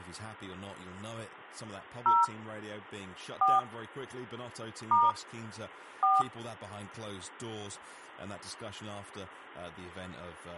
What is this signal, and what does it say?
DTMF, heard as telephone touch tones, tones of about 200 ms, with speech in English. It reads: 0 4 * 4